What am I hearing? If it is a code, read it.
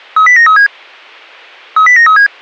Five-tone selective call (CCIR), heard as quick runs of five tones, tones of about 100 ms. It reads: 30937 30937